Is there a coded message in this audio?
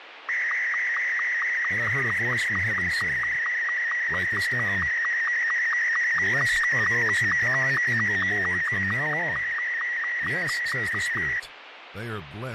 Yes: SSTV (slow-scan television), Martin M2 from 0.3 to 11.4 s, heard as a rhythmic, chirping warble, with radio static and speech in English.